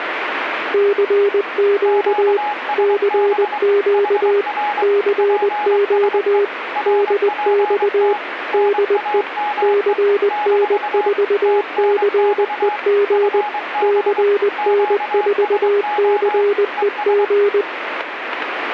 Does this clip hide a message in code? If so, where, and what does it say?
Yes: Morse code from 0.7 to 17.7 s, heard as two keyed tones, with radio static. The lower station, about 20 wpm, 400 Hz: CQ CQ CQ DX DE CN4CEG CN4CEG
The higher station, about 23 wpm, 840 Hz: QSB HR PSE RPT NAME - TNX FB QSO ES